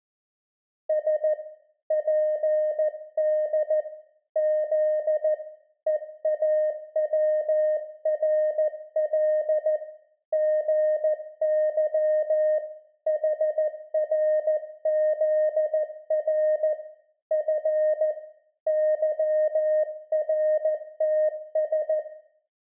Morse code (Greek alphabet), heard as a keyed tone, hand-sent with a paddle, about 14 wpm, 620 Hz, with room echo. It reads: Σ ΠΔ Ζ ΕΑΩΡΛ ΓΥ ΗΡΖΡ Φ ΥΡΤΣ